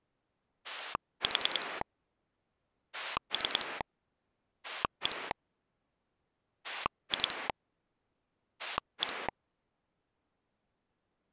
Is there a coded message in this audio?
Yes: pulse dialling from 0.6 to 9.3 s, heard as a rotary dial, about 10 pulses a second. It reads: 4 3 1 2 1